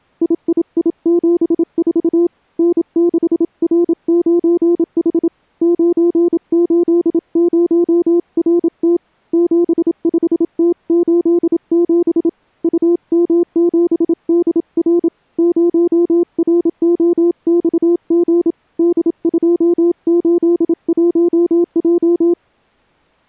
Morse code, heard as a keyed tone, hand-sent with a paddle, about 27 wpm, 350 Hz. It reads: III74 N6R9H 980RT 75T87 UM7DR 0ROXG D281J